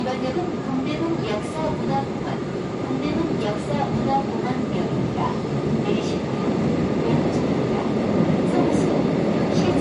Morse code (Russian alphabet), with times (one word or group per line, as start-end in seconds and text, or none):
none